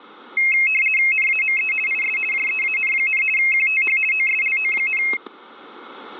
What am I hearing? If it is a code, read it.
RTTY (50 baud, 450 Hz shift), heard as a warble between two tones, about 2350 Hz centre, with static crashes. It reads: NAME IS JEAN, QTH OSLO,